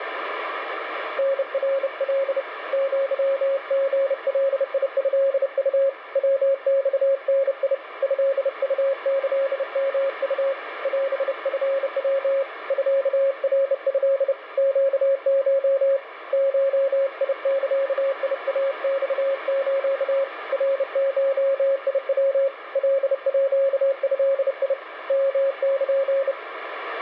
Morse code (Japanese Wabun code), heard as a keyed tone, hand-sent with a bug key, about 30 wpm, 550 Hz, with radio static. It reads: タナカ アリガトウ ヤマダ トウキヨウ オチヤ ミナト ネコ ゴザイマス ナゴヤ カード ヨル